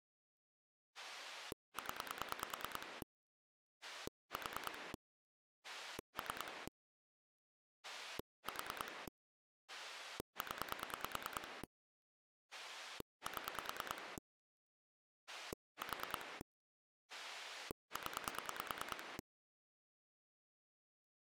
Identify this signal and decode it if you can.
Pulse dialling, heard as a rotary dial, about 9 pulses a second. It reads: 0 4 3 4 0 7 4 0